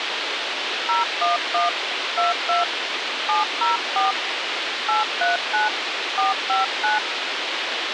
DTMF, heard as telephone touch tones, dialled by hand, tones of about 150 ms, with radio hiss. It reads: 011 22 704 839 459